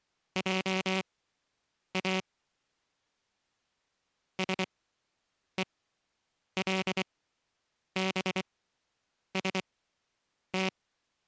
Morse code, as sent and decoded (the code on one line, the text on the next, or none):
.--- .- / ... . .-.. -... ... -
JA SELBST